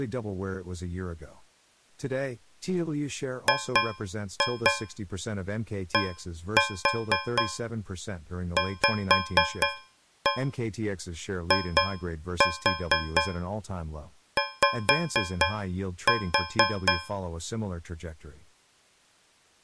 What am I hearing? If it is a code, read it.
Tap code, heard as taps on a metal pipe, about 4 knocks a second, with speech in English. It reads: GDVIY